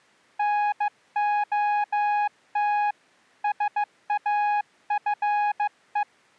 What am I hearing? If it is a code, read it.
Morse code, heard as a keyed tone, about 15 wpm, 830 Hz. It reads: NOT SAFE